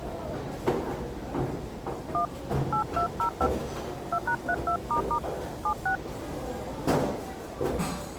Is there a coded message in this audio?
Yes: DTMF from 2.1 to 6.0 s, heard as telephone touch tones, dialled by hand, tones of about 80 ms, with the noise of a restaurant. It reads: 1 8205 2#32** 76